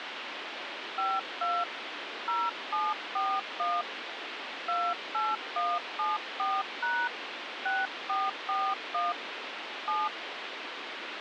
DTMF, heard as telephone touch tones, dialled by hand, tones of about 220 ms, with radio hiss. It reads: 52 0741 28174# 6441 7